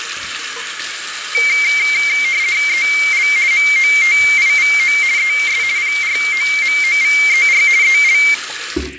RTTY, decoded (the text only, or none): EL MOTIVO ES PROMOVER EL